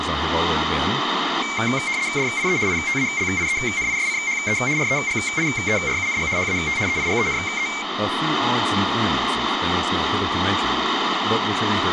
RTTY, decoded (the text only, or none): DIE ITALIENISCHE REGIERUNG HAT EIGENE